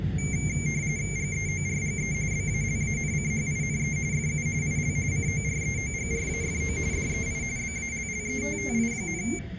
RTTY (45.45 baud, 170 Hz shift), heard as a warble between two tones, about 2200 Hz centre, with room echo and the noise inside a bus. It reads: GEORGE BALANCHINE FU IL COREOGRAFO DEI BALLETTI,